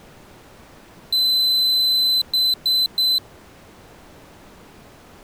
Beep code, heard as a piezo beeper, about 4050 Hz. 1 long, 3 short. In Award and IBM BIOS tables: video adapter failure; in AMI BIOS tables: memory failure.